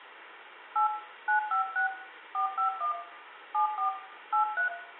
DTMF, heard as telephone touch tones, dialled by hand, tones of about 120 ms, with phone line noise and room echo. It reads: 8 956 451 74 83